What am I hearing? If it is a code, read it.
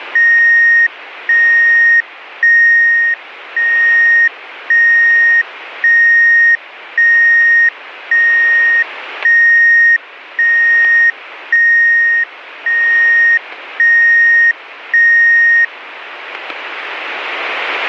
Evenly repeated beeps, with radio static. There is no code.